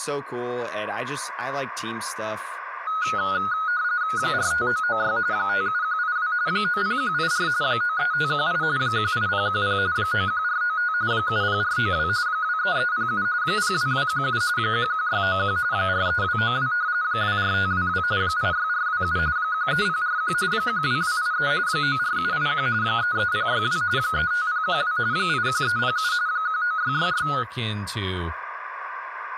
RTTY (45.45 baud, 170 Hz shift), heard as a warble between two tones, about 1360 Hz centre, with speech in English. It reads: 45996 57182 90184 93518 18010 91495 70492 23307 02217 11691 43292 24522 86427 13041 12283 94781 33062 35012 81307 19666